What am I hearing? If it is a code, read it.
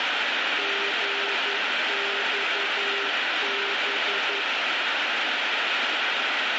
Morse code, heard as a keyed tone, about 11 wpm, 400 Hz, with heavy radio static. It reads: GXB